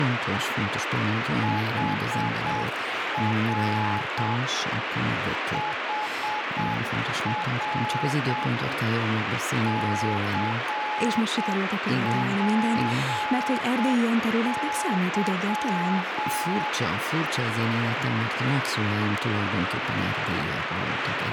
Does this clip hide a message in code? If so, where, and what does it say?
Yes: Morse code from 1.4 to 16.7 s, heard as a keyed tone, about 7 wpm, 850 Hz, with heavy radio static. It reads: HR HR CPY